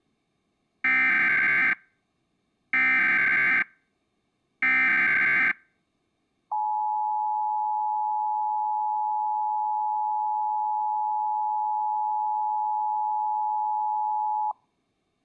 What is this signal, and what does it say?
Emergency Alert System (SAME) tones (header bursts, then the 853 and 960 Hz attention tone), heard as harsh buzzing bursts, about 520.83 baud.